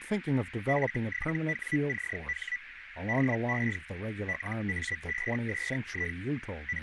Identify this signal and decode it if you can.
Hellschreiber (Feld-Hell, 122.5 baud), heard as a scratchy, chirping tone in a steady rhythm, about 1950 Hz, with radio static, a narrow filter and speech in English. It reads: F7WCH DE LA5SI …